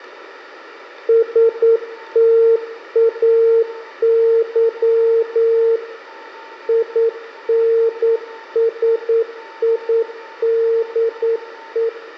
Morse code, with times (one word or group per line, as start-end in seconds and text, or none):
1.1-5.8 STAY
6.7-11.9 INSIDE